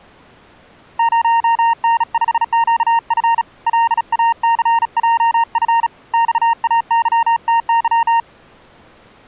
Morse code, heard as a keyed tone, hand-sent with a bug key, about 36 wpm, 920 Hz. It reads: 0N5QF LACJF XAYTY